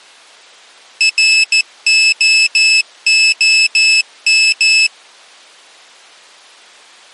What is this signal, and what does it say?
Morse code, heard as a high beeper, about 14 wpm, 2600 Hz. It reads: ROOM